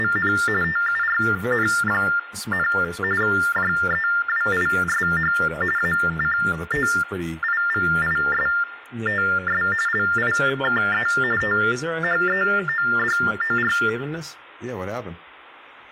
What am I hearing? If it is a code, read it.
TTY/TDD text telephone tones (45.45 baud Baudot), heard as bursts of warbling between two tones, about 400 Hz shift, 1600 Hz centre, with room echo and speech in English. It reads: … TURN, JEWISH ACTIVISTS LIKE THEODOR